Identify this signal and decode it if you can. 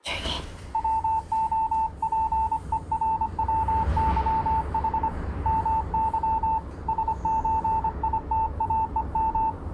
Morse code (Russian alphabet), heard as a keyed tone, hand-sent with a paddle, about 25 wpm, 890 Hz, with the noise inside a lift. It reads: ВОПЕРВЫХ МЫ СЧИТАЕМ